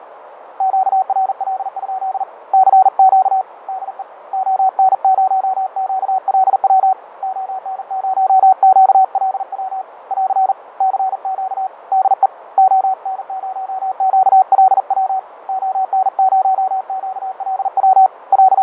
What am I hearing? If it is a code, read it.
Morse code, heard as a keyed tone, hand-sent with a paddle, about 40 wpm, 760 Hz, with radio static, fading and a narrow filter. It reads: QRL? CQ DE ON0QLW ON0QLW <AR> CQ DE ON0QLW ON0QLW …